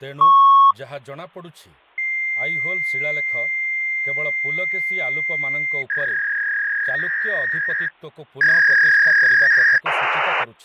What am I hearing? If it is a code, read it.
Fax machine handshake, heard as a beep, a long tone, a warble and hiss, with speech in Odia.